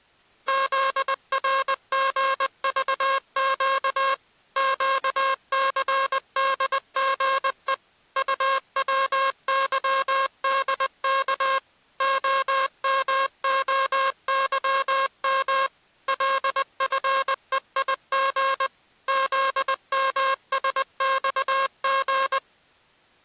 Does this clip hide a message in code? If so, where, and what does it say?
Yes: Morse code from 0.4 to 22.4 s, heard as a buzzer, machine-sent, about 20 wpm. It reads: ZRGVQ QCDGE UWYDK OMOYM LFEIG ZMSXG